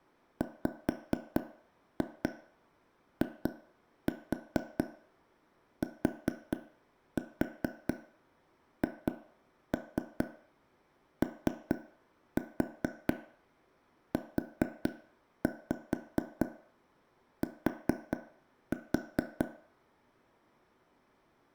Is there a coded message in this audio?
Yes: tap code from 0.4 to 19.4 s, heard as taps on a table, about 4 knocks a second, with room echo. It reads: WITHOUT